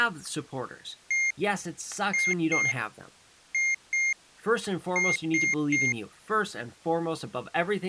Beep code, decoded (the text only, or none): 1-2-2-3